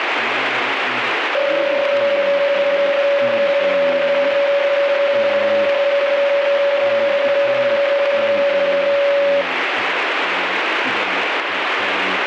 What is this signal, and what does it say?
PSK31 (31.25 baud), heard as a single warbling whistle, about 560 Hz, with radio static.